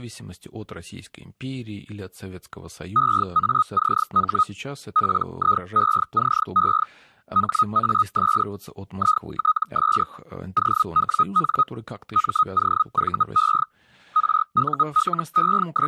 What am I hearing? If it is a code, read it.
Hellschreiber (Feld-Hell, 122.5 baud), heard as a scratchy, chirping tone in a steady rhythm, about 1260 Hz, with speech in Russian. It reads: EACH PIECE HAS ITS OWN MOVE …